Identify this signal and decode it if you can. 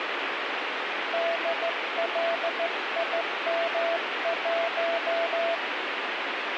Morse code, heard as a keyed tone, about 14 wpm, 670 Hz, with radio static. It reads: DLIM1